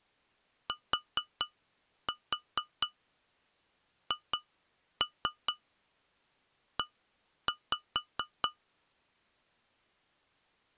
Tap code, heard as taps on glass, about 4 knocks a second. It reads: THE